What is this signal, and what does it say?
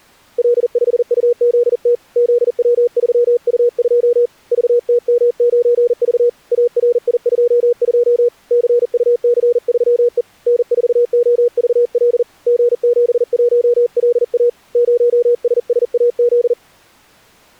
Morse code, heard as a keyed tone, hand-sent with a paddle, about 40 wpm, 480 Hz. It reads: L5UZT ZW3U2 VTM9V ARI22 CUC3E N4OVL G71LA 0SSAZ